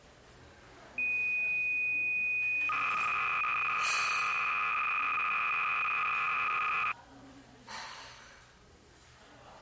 Cassette data (Kansas City type), 300 baud, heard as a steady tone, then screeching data, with the noise of a restaurant.